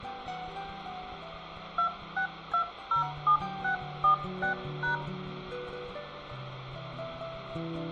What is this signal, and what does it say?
DTMF, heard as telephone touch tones, dialled by hand, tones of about 110 ms, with phone line noise and room echo. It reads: 26207646#